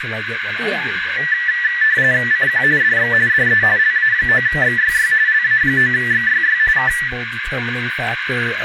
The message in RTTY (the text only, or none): CQ DX DE LA9XYY LA9XYY K